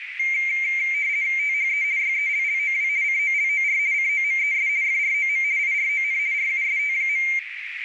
RTTY (50 baud, 170 Hz shift), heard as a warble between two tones, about 2200 Hz centre, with radio static and a narrow filter. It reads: THE YELLOW COLOR COMES FROM IRON RUST.